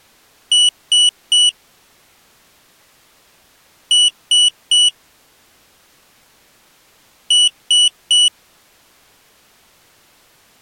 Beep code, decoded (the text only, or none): 3 short